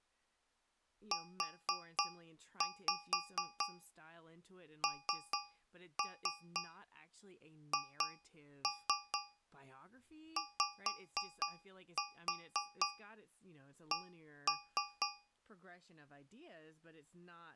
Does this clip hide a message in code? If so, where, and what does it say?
Yes: tap code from 1.1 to 15.4 s, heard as taps on a metal pipe, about 4 knocks a second, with speech in English. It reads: UNHYC